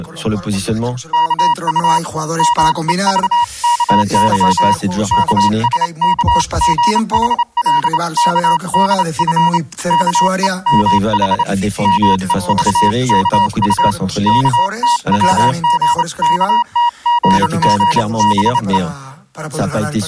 Morse code (Korean alphabet), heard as a keyed tone, hand-sent with a straight key, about 28 wpm, 960 Hz. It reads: 이 말에 영숙은 아무 말이 없었다